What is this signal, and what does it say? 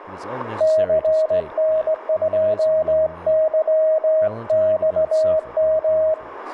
Morse code, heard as a keyed tone, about 18 wpm, 630 Hz, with radio static and speech in English. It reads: CN2YXM